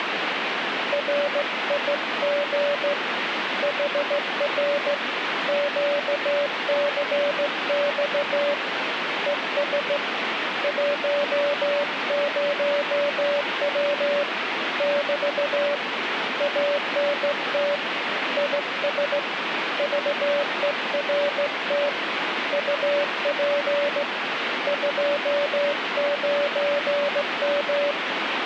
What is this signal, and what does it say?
Morse code, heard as a keyed tone, hand-sent with a straight key, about 16 wpm, 580 Hz, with radio static. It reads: RIG HR QCX ES 10W <BT> ANT IS VERT UP 29M